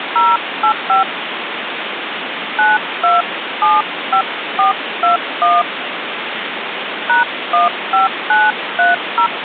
DTMF, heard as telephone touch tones, dialled by hand, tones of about 150 ms, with phone line noise. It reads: 085 9275421 #15930